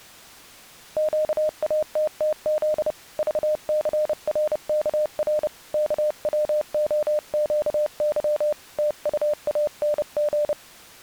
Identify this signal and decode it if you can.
Morse code, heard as a keyed tone, hand-sent with a paddle, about 30 wpm, 600 Hz. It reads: QATTZ VCRKR KWOQY TUANG